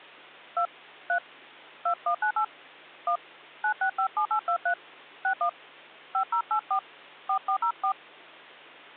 DTMF, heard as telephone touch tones, dialled by hand, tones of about 90 ms, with hum. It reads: 2 3 2198 1 9657823 61 5084 4404